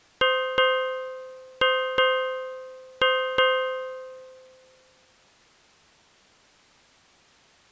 Ship's bell, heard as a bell. 6. Six half-hours of the watch have passed.